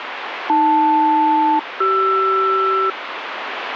Aircraft SELCAL, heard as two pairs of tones, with radio static. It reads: AL-CR